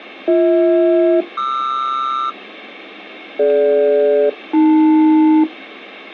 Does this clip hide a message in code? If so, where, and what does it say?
Yes: aircraft SELCAL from 0.3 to 5.4 s, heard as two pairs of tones. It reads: BH-QR DG-AL